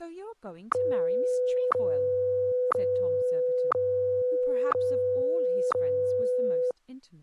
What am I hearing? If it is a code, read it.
Radio time signal (WWVH, Hawaii), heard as ticks, one a second, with speech in English.